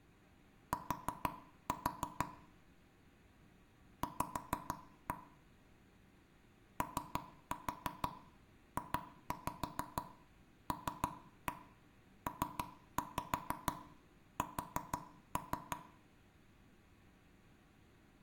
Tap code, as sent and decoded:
4-4 / 5-1 / 3-4 2-5 3-1 3-5 4-3
T V OJLPS

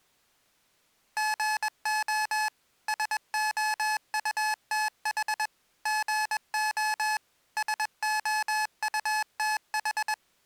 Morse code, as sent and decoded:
--. --- / ... --- ..- - .... / --. --- / ... --- ..- - ....
GO SOUTH GO SOUTH

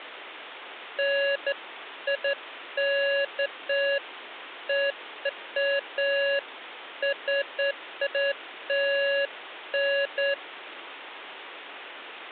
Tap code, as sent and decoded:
none

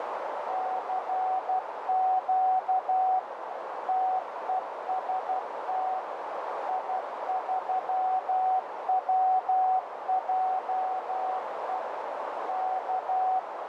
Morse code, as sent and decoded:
-.-. --.- / - . ... - / .. ...-- .-- .--- . / -.-
CQ TEST I3WJE K

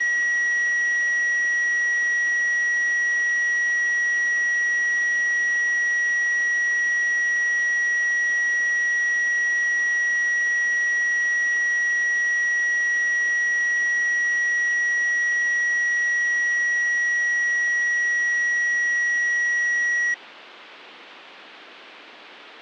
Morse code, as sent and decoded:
none

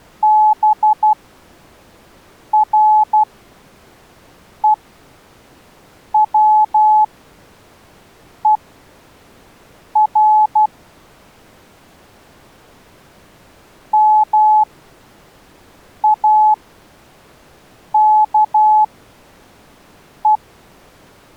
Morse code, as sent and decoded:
-... .-. . .-- . .-. / -- .- -.- .
BREWER MAKE

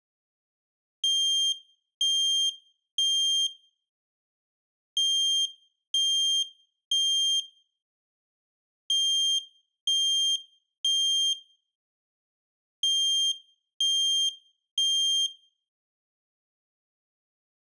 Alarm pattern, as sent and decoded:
3 beeps and a pause
temporal three

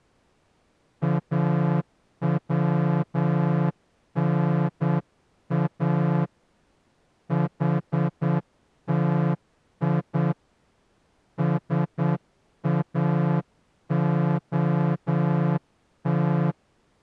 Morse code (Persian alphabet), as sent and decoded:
.- .-- -. .- / .... - .. / ... .- --- -
اونا حتی ساعت

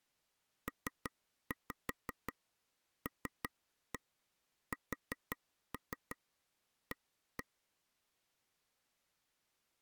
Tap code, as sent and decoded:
3-5 3-1 4-3 1-1
PLSA

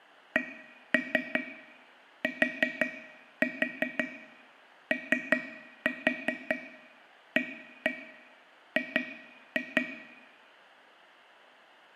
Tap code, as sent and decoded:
1-3 4-4 3-4 1-1 2-2
CTOAG

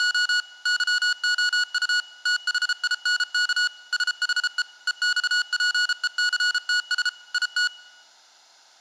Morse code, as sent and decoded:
… / -.-- --- ..- / - .... .. -. -.- / ... .... . / . -..- .--. . -.-. - ... / .. -
… YOU THINK SHE EXPECTS IT

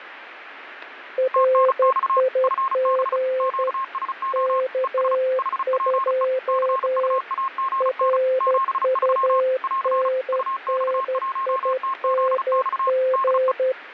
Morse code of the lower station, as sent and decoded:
.-. .. --. / -.- ..--- / .-. ..- -. -. .. -. --.
RIG K2 RUNNING

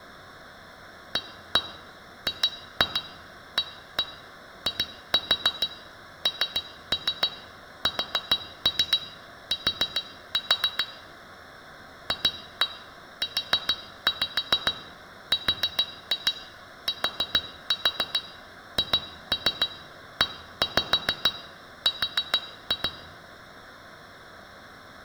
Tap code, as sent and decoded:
1-1 2-2 1-1 2-4 3-3 4-3 4-4 / 2-1 4-5 4-2 4-4 2-3 1-5 4-2
AGAINST FURTHER

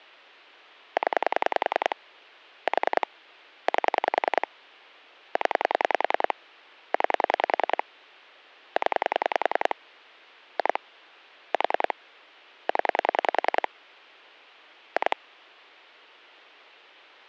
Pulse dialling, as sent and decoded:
10 / 4 / 8 / 10 / 9 / 10 / 2 / 4 / 10 / 2
0 4 8 0 9 0 2 4 0 2

